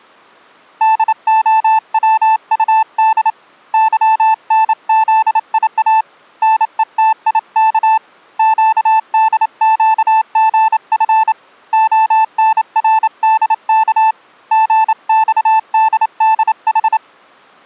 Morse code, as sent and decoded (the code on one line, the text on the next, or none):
-.. --- .-- ..- -.. / -.-- -. --.. .. .- / -. . - .. -.- / --.- -.. --.- --. ..-. / --- -. .-. -.. -.- / --. -..- -.. -.. ....
DOWUD YNZIA NETIK QDQGF ONRDK GXDDH